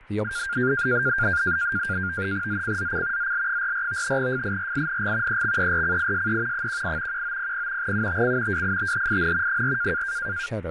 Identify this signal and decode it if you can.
NAVTEX (SITOR-B), 100 baud, 170 Hz shift, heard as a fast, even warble, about 1500 Hz centre, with speech in English. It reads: ZCZC ZL44 FIRING EXERCISE 18 1900 UTC WITHIN 4